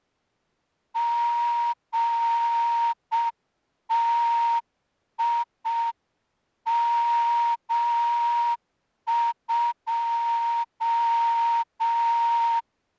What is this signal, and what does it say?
Morse code, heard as a whistle, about 6 wpm. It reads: GTIM2